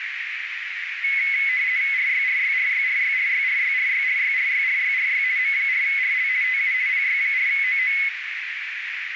RTTY (50 baud, 170 Hz shift), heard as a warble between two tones, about 2100 Hz centre, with radio static and a narrow filter. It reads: RYRYRYRYRYRYRYRYRYRYRY M4RL TU PY4OO